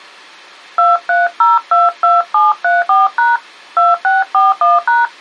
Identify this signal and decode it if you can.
DTMF, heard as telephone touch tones, dialled by hand, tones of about 180 ms. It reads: 23022734# 2641#